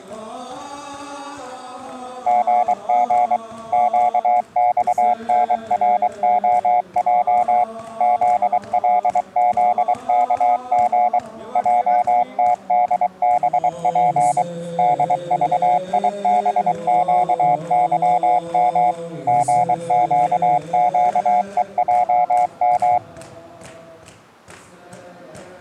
Morse code, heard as a keyed tone, machine-sent, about 23 wpm, 720 Hz. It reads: GG QXNROJ ZLZKG JTDBP DVIBQYM GQQEJM